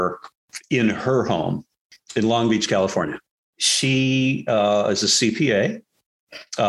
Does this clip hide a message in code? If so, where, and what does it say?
No.